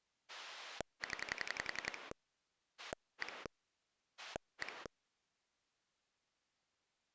Pulse dialling, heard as a rotary dial, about 11 pulses a second. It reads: 0 1 1